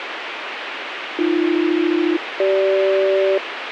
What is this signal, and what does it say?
Aircraft SELCAL, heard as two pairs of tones, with radio hiss. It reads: AB-CG